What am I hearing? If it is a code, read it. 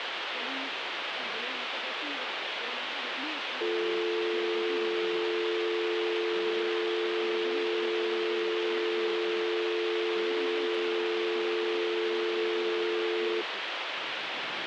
Telephone call progress tone (North American or UK plan), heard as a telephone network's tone, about 350, 440 Hz, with phone line noise. Dial tone.